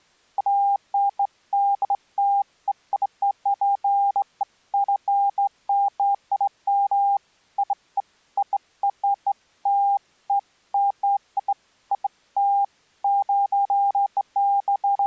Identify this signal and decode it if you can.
Beeps of irregular length. There is no code.